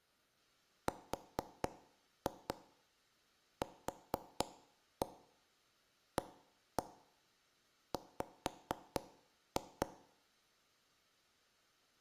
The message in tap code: RQAW

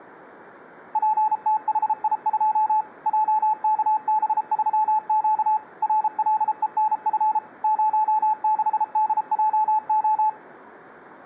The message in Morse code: PTHI2 JKB3Q RLENF 06DJO

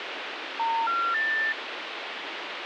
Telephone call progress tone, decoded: special information tone

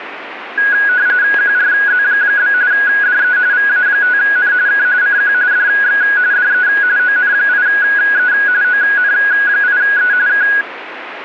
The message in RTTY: QRZ? DE VA5N K CQ DX DE ON8E ON8E K

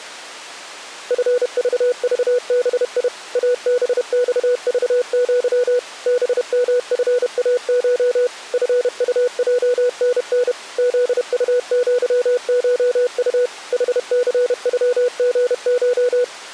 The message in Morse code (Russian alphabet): ФЖЖБИ АБЬЖЪ БМФАШ ФУЙНН ЗУЪШУ ХЦЮГШ

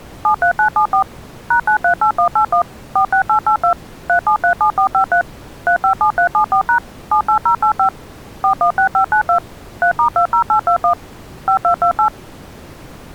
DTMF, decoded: 73974 #938181 46882 3737453 357374# 78085 416592 3*20821 5228

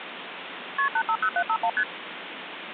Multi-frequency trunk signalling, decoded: KP 850751 ST

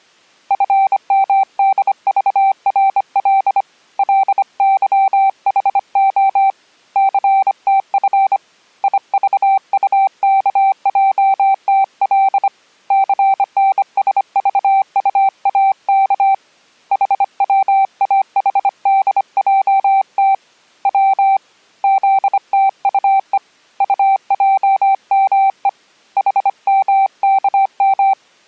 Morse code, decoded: FMDVRL LYHO CTF IVUKJTL CNSVUAK HWAHDJT W ZTUE UJME HMKM

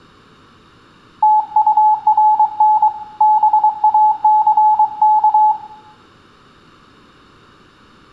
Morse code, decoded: TURN BACK

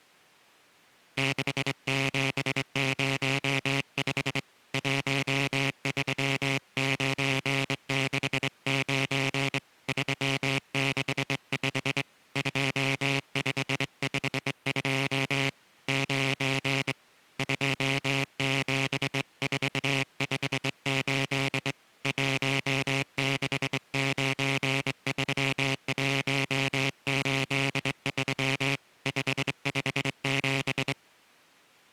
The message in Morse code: 6705 13969 365 2552 9 27458 1693183 557

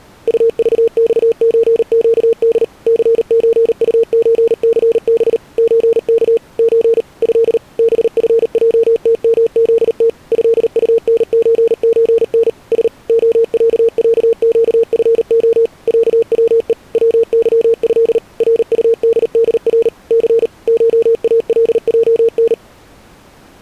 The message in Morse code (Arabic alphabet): طضصزقد ثزطزثب زك ز ه بفجتمذت هطنززن س خععقفخ عوء وظه رطددر ث شالجن

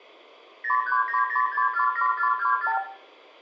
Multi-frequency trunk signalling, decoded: 0390647424

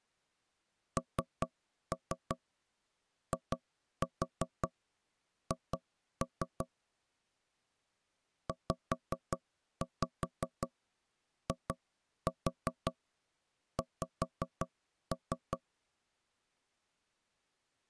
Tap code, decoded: NIH ZIX

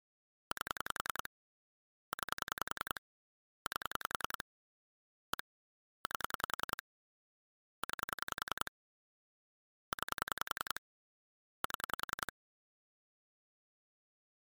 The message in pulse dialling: 8 9 8 1 8 9 9 7

